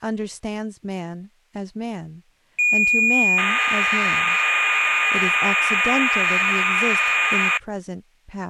Cassette data (Kansas City type), 1200 baud, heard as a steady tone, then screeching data, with speech in English.